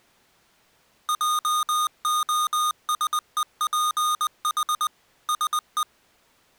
Morse code, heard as electronic beeps, machine-sent, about 20 wpm, 1230 Hz. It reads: JOSEPH SE